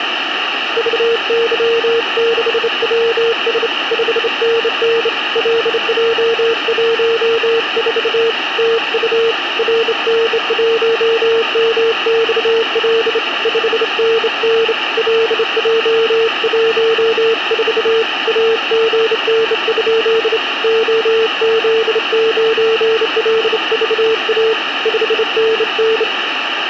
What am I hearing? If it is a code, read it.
Morse code, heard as a keyed tone, hand-sent with a straight key, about 28 wpm, 450 Hz, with radio static. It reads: VY6WS 5NN LJ14 TU RN1MXL 5NN LJ14 AGN? OZ9LVA 5NN